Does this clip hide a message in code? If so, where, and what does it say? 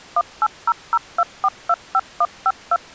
Yes: DTMF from 0.2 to 2.8 s, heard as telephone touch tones, dialled by machine, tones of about 50 ms. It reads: 18002425152